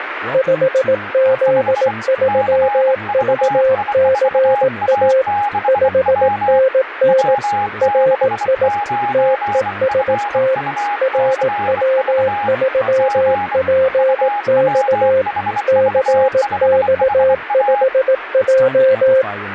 Morse code, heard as two keyed tones, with radio static and speech in English. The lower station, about 18 wpm, 530 Hz: 5Z3VCA 5NN RI TEST RW3PX CX5J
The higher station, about 24 wpm, 820 Hz: 5 CVI4A6W W69FUCV G UWHV5HA